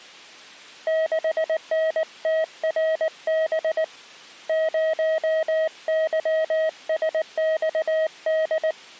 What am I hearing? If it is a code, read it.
Morse code, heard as a keyed tone, hand-sent with a paddle, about 19 wpm, 640 Hz. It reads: 6NTRB 0YSXD